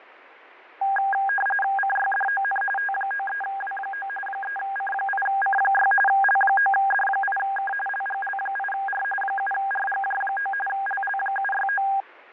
RTTY (45.45 baud, 850 Hz shift), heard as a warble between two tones, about 1210 Hz centre, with radio static and fading. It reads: CYDON T93W9 3C8C6 L9D8K LGL8R 7RGJ9 LL769